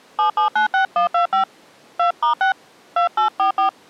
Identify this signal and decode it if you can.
DTMF, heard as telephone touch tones, dialled by hand, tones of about 110 ms. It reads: 7796125 2*6 2844